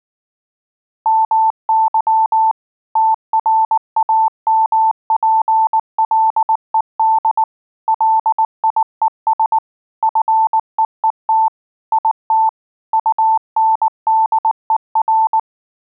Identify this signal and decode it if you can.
Morse code, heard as a keyed tone, machine-sent, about 19 wpm, 880 Hz. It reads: MY TRAMPLED LIES FEET IT UNDER